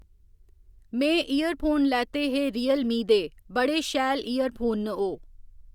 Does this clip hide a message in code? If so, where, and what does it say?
No, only speech in Dogri.